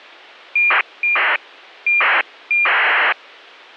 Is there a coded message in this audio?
Yes: ACARS aircraft data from 0.6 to 3.1 s, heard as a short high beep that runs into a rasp, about 2400 baud.